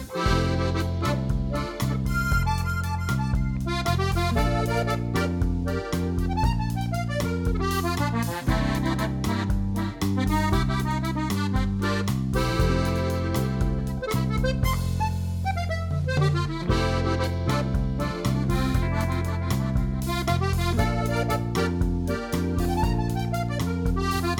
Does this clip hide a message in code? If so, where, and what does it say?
No.